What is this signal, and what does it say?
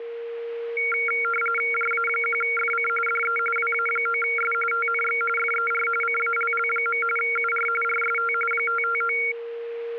RTTY (45.45 baud, 850 Hz shift), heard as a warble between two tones, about 1800 Hz centre, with a steady whistle near 470 Hz. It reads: JA1FC DE WA9S TNX FER CALL. UR RST 559